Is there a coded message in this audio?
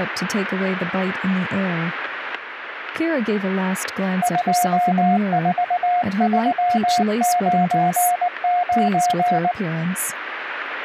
Yes: Morse code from 4.2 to 9.6 s, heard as a keyed tone, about 19 wpm, 710 Hz, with static crashes and speech in English. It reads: 24399